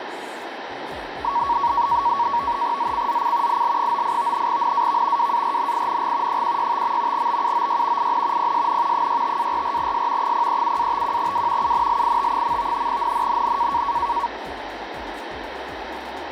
NAVTEX (SITOR-B), 100 baud, 170 Hz shift, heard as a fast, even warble, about 1030 Hz centre, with radio static. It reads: ZCZC IL98 NAV WARNING 165. BUOY IN PSN 65-44S 037-51W UNLIT. NNNN